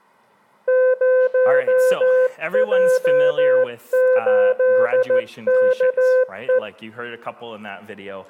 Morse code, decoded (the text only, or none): 0J8KE